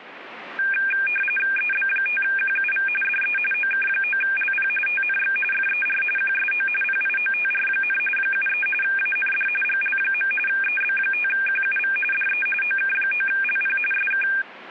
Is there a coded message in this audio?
Yes: RTTY (45.45 baud, 850 Hz shift) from 0.6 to 14.4 s, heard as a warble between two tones, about 2000 Hz centre. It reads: EB5QUV DE OK9LP TNX FER QSO PIOTR, 73 AND GL. EB5QUV DE OK9LP SK